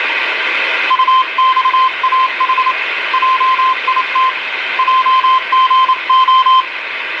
Morse code, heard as a keyed tone, hand-sent with a paddle, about 28 wpm, 1040 Hz, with radio static. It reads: UXAH JIT JGO